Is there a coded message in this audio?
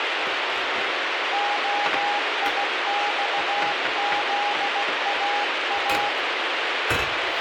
Yes: Morse code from 1.3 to 6.2 s, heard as a keyed tone, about 16 wpm, 820 Hz, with heavy radio static and kitchen noise. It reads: OIXZAA